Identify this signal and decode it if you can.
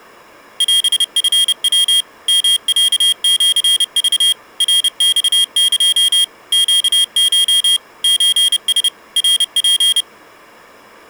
Morse code (Japanese Wabun code), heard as a high beeper, machine-sent, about 30 wpm, 3250 Hz. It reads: オチヤ ヨロシク ナマエ ネコ ソラ ナツ